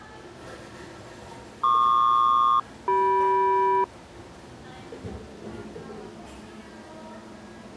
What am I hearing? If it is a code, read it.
Aircraft SELCAL, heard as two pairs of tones, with the noise of a cafe. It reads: PQ-CM